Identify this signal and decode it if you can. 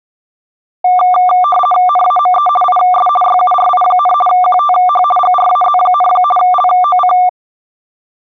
RTTY (50 baud, 450 Hz shift), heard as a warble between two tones, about 950 Hz centre. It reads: NAME IS YURI, QTH GRAZ, LOC